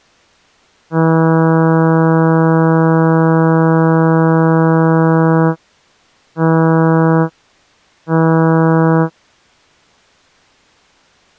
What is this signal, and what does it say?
Ship horn signal, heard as a ship's horn, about 160 Hz. 1 long, 2 short. At sea: a vessel in fog that is sailing, fishing, towing or hampered.